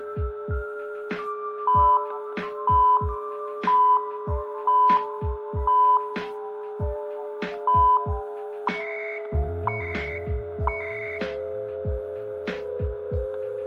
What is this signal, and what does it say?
Radio time signal (CHU, Canada), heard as beeps and data bursts, one a second, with static crashes and a steady whistle near 420 Hz.